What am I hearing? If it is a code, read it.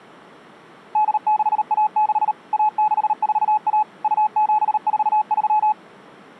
Morse code (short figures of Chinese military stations), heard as a keyed tone, machine-sent, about 38 wpm, 850 Hz. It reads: 8616 1641 2743